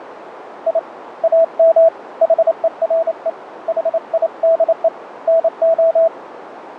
Morse code, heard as a keyed tone, hand-sent with a paddle, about 28 wpm, 660 Hz, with radio static and a narrow filter. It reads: I AM HERE HIDE NO